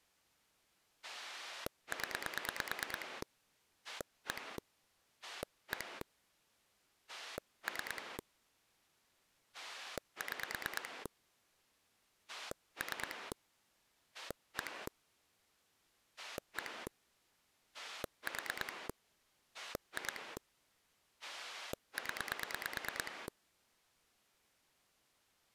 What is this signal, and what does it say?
Pulse dialling, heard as a rotary dial, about 9 pulses a second. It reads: 0 1 1 3 6 3 1 1 4 2 0